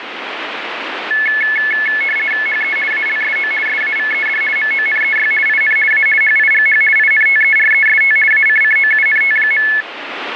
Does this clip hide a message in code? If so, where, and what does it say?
Yes: RTTY (50 baud, 450 Hz shift) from 1.1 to 9.8 s, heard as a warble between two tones, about 1950 Hz centre, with radio static. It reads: HE ALSO SAVED MONEY IN A HIGH INTEREST ACCOUNT.